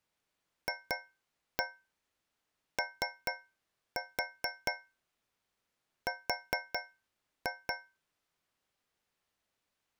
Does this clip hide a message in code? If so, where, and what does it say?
Yes: tap code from 0.7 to 8.0 s, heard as taps on a metal pipe, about 4 knocks a second. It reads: FOR